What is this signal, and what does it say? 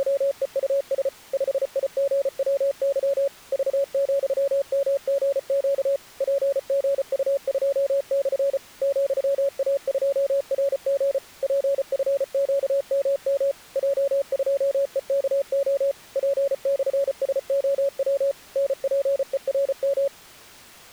Morse code, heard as a keyed tone, machine-sent, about 34 wpm, 560 Hz. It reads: … 5IGWY V,MGQ PGU2/ ,A2RG PFQMM J2EKO P/SOW NPERM